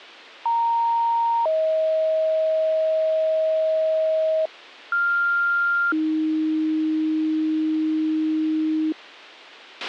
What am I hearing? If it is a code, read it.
Two-tone page, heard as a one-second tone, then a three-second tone, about 930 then 630 Hz, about 1400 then 310 Hz, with a squelch burst at the end.